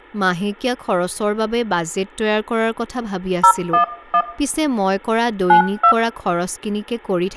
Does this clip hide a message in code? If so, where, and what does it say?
Yes: DTMF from 3.4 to 5.9 s, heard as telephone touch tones, dialled by hand, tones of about 80 ms, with room echo and speech in Assamese. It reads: 011 92